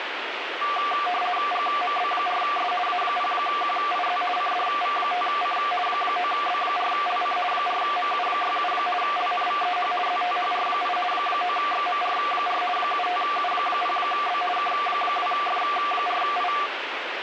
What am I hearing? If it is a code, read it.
RTTY (50 baud, 450 Hz shift), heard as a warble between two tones, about 940 Hz centre, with radio static. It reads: GMB4S A0QIZ CDV5C 9B4LC 4MU67 LNVEH ZTHR8 9XMR4 75U0B K2F4I